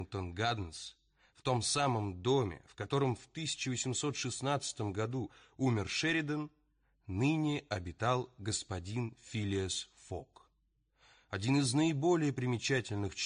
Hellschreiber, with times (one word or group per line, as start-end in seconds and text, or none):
none